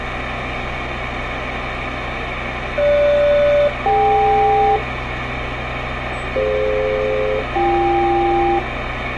Aircraft SELCAL, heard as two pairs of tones, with radio static and street noise. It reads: GS-DK DF-BK